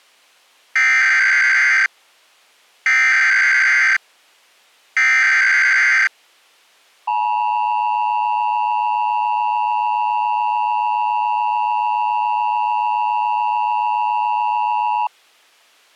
Emergency Alert System (SAME) tones (header bursts, then the 853 and 960 Hz attention tone), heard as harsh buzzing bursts, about 520.83 baud.